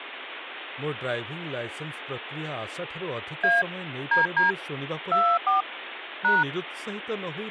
DTMF, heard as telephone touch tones, dialled by hand, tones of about 200 ms, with phone line noise and speech in Odia. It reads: A DD 24 #